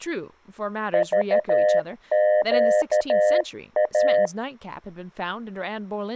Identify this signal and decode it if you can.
Morse code, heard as a keyed tone, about 13 wpm, 610 Hz, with speech in English. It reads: VQA